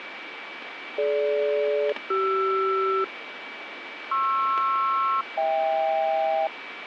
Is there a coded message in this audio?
Yes: aircraft SELCAL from 1.0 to 6.5 s, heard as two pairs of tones, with radio static and a steady whistle near 2300 Hz. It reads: DG-CR PR-HK